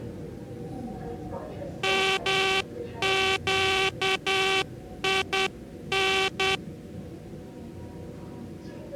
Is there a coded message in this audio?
Yes: Morse code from 1.8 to 6.6 s, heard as a buzzer, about 10 wpm, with the noise inside a subway train. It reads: MQIN